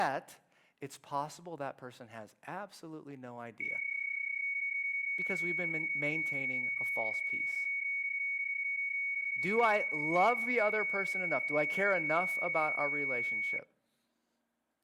PSK31 (31.25 baud), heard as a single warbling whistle, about 2250 Hz, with speech in English.